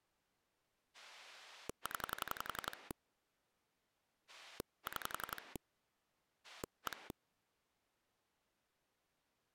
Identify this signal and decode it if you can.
Pulse dialling, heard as a rotary dial, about 11 pulses a second. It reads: 0 6 1